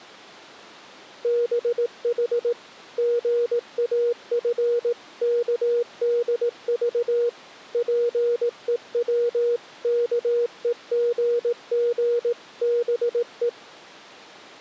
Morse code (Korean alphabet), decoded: 두 손을 잡았다

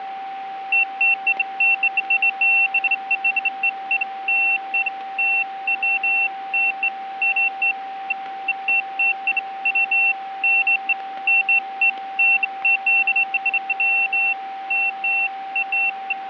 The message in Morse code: none

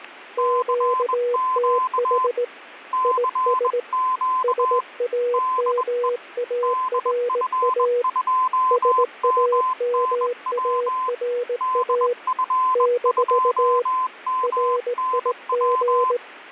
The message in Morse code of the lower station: QTH IS SAMARA SAMARA - RIG

